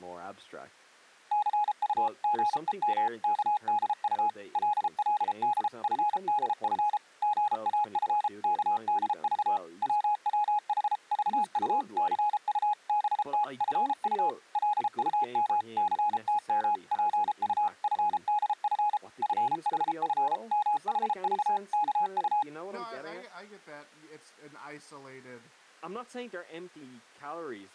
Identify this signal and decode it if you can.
Morse code (Korean alphabet), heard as a keyed tone, machine-sent, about 33 wpm, 840 Hz, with speech in English. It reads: 치삼의 끄는 손을 뿌리치더니 김첨지는 눈물이